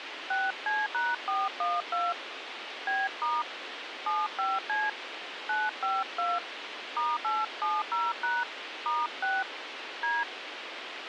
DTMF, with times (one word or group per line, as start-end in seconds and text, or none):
0.3-2.1 6C#412
2.9-3.4 B*
4.1-4.9 75C
5.5-6.4 952
7.0-8.4 *870#
8.9-9.4 *6
10.0-10.2 D